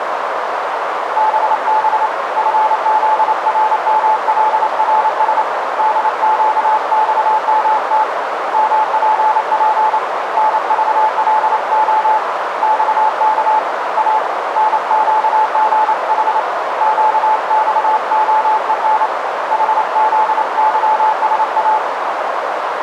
Morse code, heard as a keyed tone, hand-sent with a paddle, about 28 wpm, 870 Hz, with heavy radio static and a narrow filter. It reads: BB FZRMLRS DQXMT MPP NVLO XK A NQGH QXOEN HZYSA